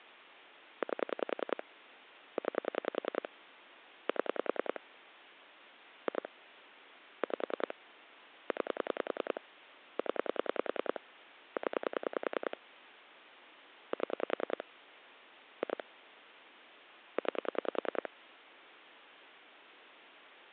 Pulse dialling, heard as clicks on a phone line, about 10 pulses a second. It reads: 8 9 7 2 5 9 0 0 7 2 9